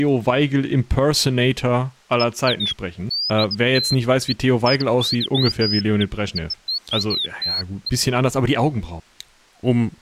Bird-like chirps, with speech in German. There is no code.